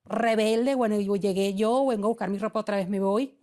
Speech in Spanish. There is no code.